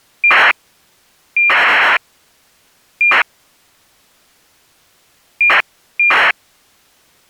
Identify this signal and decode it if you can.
ACARS aircraft data, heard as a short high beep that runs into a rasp, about 2400 baud.